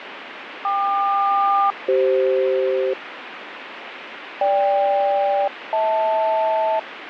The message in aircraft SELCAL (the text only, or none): KQ-CF GK-HL